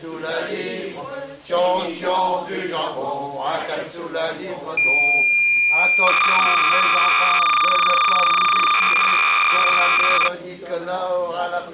Cassette data (Kansas City type), 300 baud, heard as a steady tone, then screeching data.